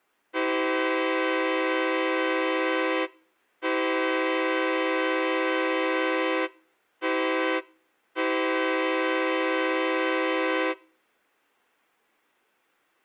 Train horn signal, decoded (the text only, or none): 2 long, 1 short, 1 long